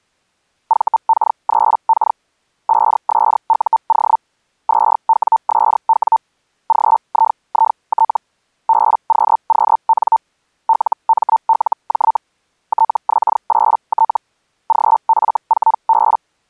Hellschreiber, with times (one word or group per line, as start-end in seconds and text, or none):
0.7-2.2 VK3K
2.7-4.2 5SUO
4.7-6.2 2WSW
6.7-8.2 GIIT
8.7-10.2 BQQN
10.7-12.2 LMLJ
12.7-14.2 TX8T
14.7-16.2 GF4B